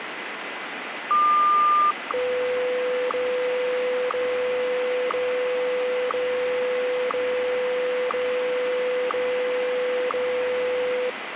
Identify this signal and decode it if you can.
Radio time signal (WWVH, Hawaii), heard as ticks, one a second, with radio static.